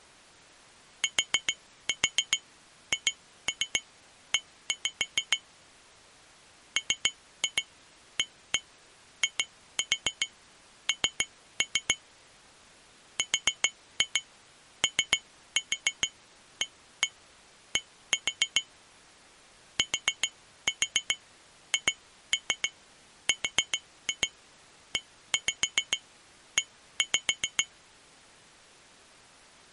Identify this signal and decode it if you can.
Tap code, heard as taps on glass, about 7 knocks a second. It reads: THE MAIN ROAD THREE